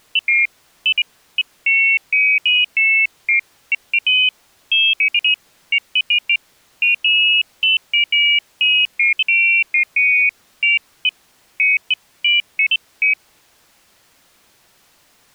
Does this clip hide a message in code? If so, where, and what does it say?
No, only pairs of high tones at irregular times.